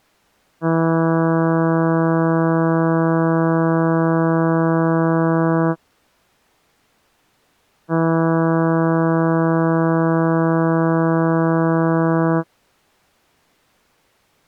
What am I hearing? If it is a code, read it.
Ship horn signal, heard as a ship's horn, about 160 Hz. 2 long. At sea: a vessel under power that has stopped in fog.